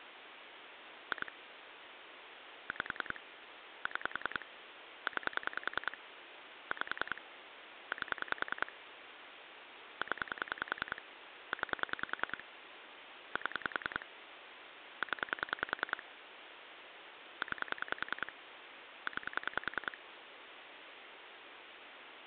Pulse dialling, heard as clicks on a phone line, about 10 pulses a second, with phone line noise. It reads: 2 5 6 9 5 8 0 9 7 0 9 9